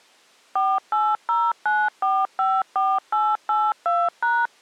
DTMF, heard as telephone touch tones, dialled by machine, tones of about 230 ms. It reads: 4809454882#